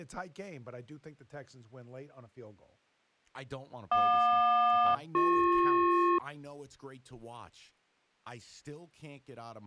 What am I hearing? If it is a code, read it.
Aircraft SELCAL, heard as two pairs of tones, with speech in English. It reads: JQ-BP